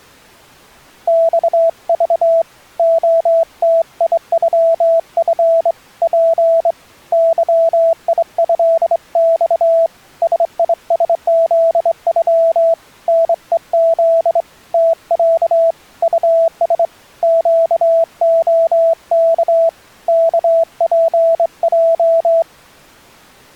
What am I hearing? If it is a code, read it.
Morse code (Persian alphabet), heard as a keyed tone, hand-sent with a straight key, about 24 wpm, 660 Hz. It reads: خذ عتیغف پ ظیضخ سیسزغ نهز تص طس گعک کپج